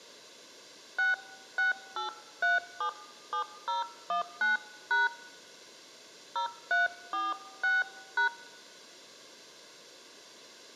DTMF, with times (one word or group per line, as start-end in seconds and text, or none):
1.0-5.1 668377019#
6.4-8.3 0346#